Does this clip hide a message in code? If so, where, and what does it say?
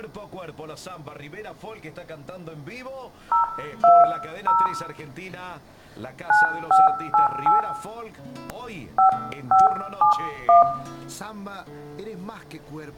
Yes: DTMF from 3.3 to 10.6 s, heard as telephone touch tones, dialled by hand, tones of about 150 ms, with room echo. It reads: 020 9588 5571